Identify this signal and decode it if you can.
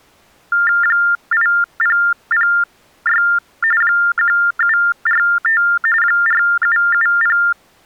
TTY/TDD text telephone tones (45.45 baud Baudot), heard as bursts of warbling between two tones, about 400 Hz shift, 1600 Hz centre. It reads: 8006 1745 4770